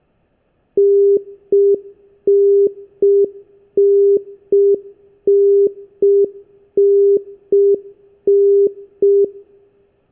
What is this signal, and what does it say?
Telephone call progress tone (UK plan), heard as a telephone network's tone, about 400 Hz. Congestion tone.